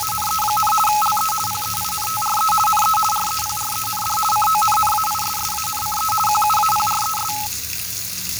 RTTY (50 baud, 450 Hz shift), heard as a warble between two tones, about 1070 Hz centre, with fading and the noise of a restroom. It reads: … LE PEINTRE NE REPREND CONNAISSANCE QUAPRES